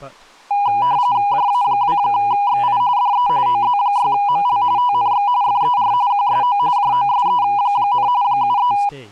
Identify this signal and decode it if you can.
RTTY (45.45 baud, 170 Hz shift), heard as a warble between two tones, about 900 Hz centre, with speech in English. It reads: JA2XI DE OZ6ML TNX FER QSO JOSE, 73